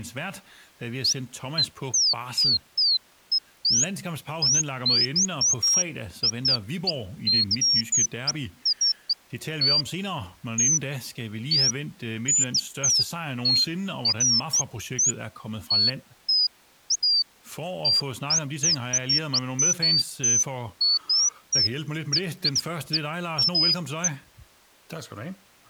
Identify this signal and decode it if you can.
Bird-like chirps, with speech in Danish. There is no code.